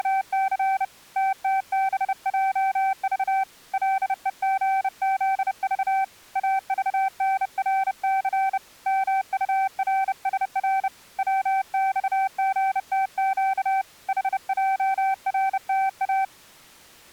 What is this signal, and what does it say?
Morse code, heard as a keyed tone, hand-sent with a bug key, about 30 wpm, 770 Hz. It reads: … TTBJV LEGZV AVNRC MURSR WXGTQ HJRTA